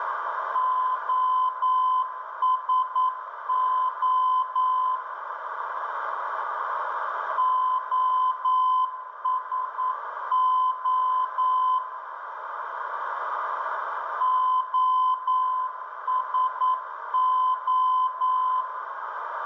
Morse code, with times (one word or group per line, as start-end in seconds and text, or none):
0.6-5.0 OSO
7.4-11.8 OSO
14.2-18.6 OSO